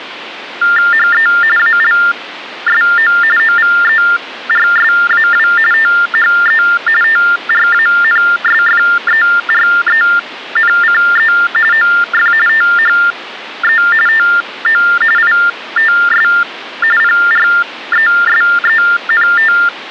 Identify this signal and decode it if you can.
TTY/TDD text telephone tones (45.45 baud Baudot), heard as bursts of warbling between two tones, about 400 Hz shift, 1600 Hz centre, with phone line noise. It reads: HE ALSO OVERSAW THE TRANSFERENCE OF THE TO ITS PRESENT